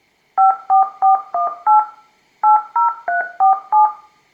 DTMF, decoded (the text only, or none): 54418 80347